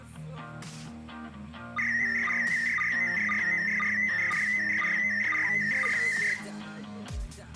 SSTV (slow-scan television), PD 120, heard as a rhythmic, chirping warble, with room echo.